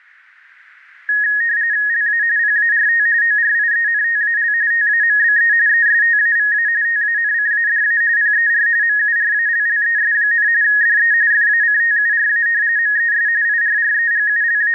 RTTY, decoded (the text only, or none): LA PART ORIENTAL TAMBE ESTAVA TANCADA PER MURALLES, DE FACTURA MES …